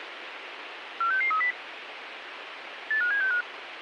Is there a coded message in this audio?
Yes: five-tone selective call (CCIR) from 1.0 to 3.4 s, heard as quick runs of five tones, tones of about 100 ms, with radio hiss. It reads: 46630 85765